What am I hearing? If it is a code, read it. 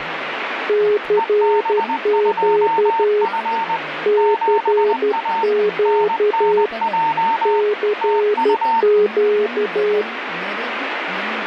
Morse code, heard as two keyed tones, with radio static and speech in Kannada. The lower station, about 12 wpm, 420 Hz: CQ CQ CQ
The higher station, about 20 wpm, 910 Hz: EB2F 7A NNJ TU